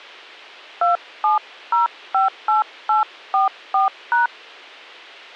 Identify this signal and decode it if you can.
DTMF, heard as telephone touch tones, dialled by hand, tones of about 140 ms. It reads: 27058844#